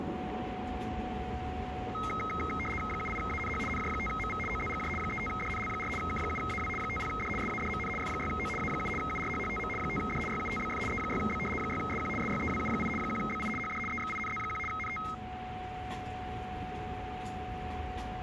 RTTY (75 baud, 850 Hz shift), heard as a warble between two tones, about 1700 Hz centre, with radio static and a steady whistle near 740 Hz. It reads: 78ANH NJ5MV OZGJ 35DNL4 K7AW 50D SADMN F6O A7 URHHTM 5D YUTBF E6B 6SQ SYEWU8 1BI HD EXINZ1 NT